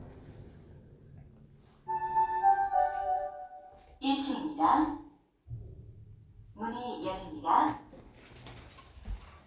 The noise inside a lift. There is no code.